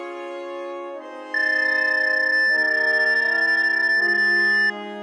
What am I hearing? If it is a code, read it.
PSK31 (31.25 baud), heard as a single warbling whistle, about 1750 Hz.